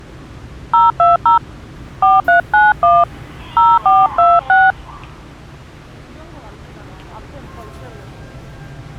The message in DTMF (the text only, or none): 020 4391 0426